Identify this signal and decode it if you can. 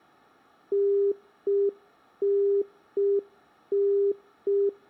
Telephone call progress tone (UK plan), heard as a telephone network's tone, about 400 Hz. Congestion tone.